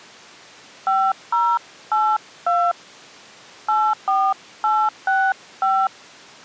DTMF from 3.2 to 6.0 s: 84865

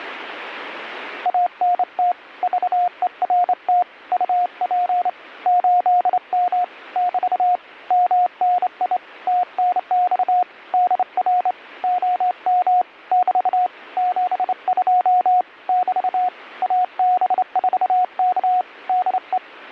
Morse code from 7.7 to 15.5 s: MNI TNX DR OM <BT> 72

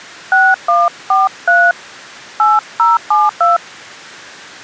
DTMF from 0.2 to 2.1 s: 6143

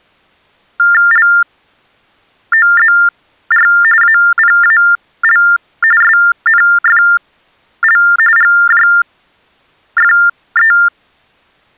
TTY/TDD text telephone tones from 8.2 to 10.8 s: GJFE

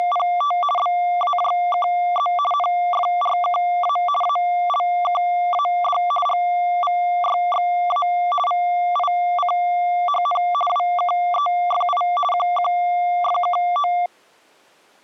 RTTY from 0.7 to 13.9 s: BAJKZ NFRKA ALKAD GVYXA VICHN WKEFI QQFKO

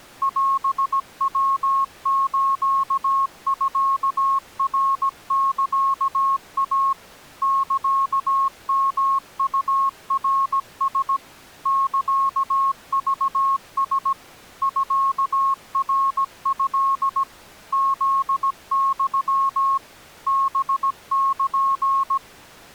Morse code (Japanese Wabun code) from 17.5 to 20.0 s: フユ

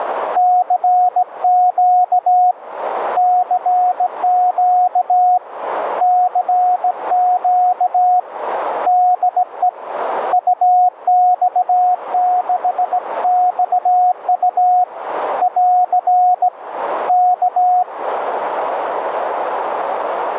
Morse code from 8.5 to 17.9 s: DE UX6XU <AR> K

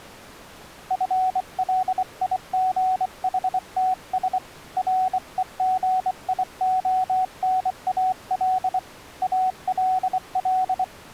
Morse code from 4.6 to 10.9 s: REGIONAL ALL

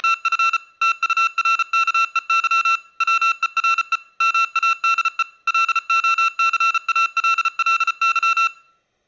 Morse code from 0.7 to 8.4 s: TURKEY WERE MADE LOCALLY

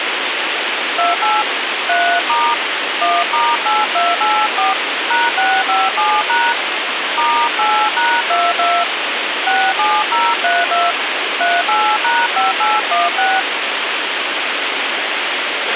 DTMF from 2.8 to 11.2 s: 1*8284 #657# *8#22 67032

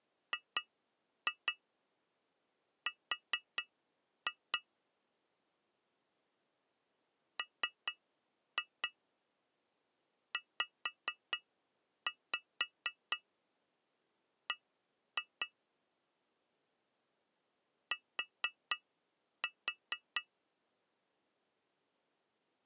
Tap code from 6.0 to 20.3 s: MZB T

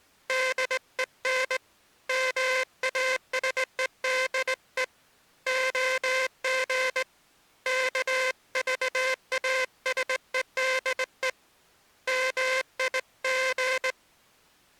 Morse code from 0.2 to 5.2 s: DEN MASEDE

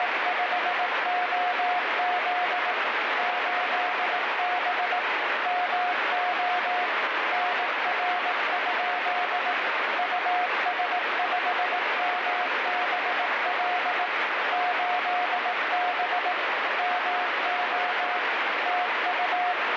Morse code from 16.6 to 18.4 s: MO

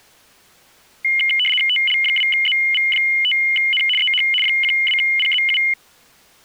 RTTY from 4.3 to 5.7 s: 12PZU

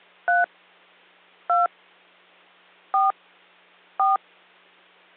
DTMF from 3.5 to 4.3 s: 4

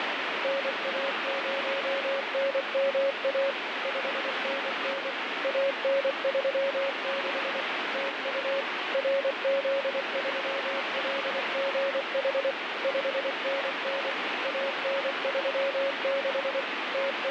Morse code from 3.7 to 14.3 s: 5NN AN36 TU RZ3LGH 5NN

